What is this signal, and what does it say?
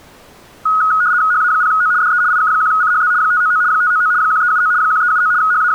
RTTY (75 baud, 170 Hz shift), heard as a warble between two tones, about 1360 Hz centre. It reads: HA0O DE IK1CHZ 599 599 1379 1379 …